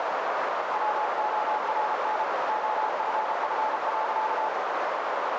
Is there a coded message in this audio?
Yes: Morse code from 0.7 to 4.5 s, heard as a keyed tone, machine-sent, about 33 wpm, 860 Hz, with heavy radio static and a narrow filter. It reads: WORN OFF.